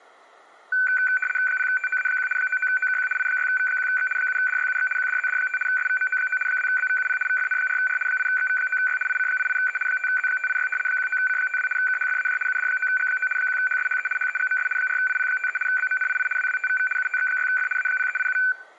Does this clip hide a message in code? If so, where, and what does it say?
Yes: RTTY (75 baud, 850 Hz shift) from 0.7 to 18.5 s, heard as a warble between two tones, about 1950 Hz centre. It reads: 0TOA1 99OKQ I6V1X 7DYUX QDZD5 SVMO9 2BVUP VFN4R 8XV9Y IC88E 5Z586 19C52 KHFAJ UD9G9 1HSHE HEGMS 4IP53 BMNII WWTVV UTX6F A0387